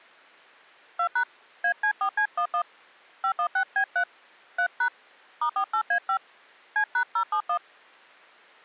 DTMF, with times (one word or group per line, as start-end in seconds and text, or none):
1.0-1.2 2#
1.6-2.6 AC4C11
3.2-4.0 516B3
4.6-4.9 3#
5.4-6.2 *48A5
6.8-7.6 C#071